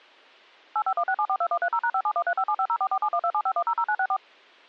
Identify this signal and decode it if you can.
DTMF, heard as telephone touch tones, dialled by machine, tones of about 70 ms. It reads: 8516742130#571357504471275100964